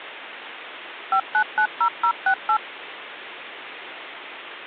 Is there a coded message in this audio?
Yes: DTMF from 1.1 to 2.6 s, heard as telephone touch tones, dialled by machine, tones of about 80 ms, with phone line noise. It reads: 5990068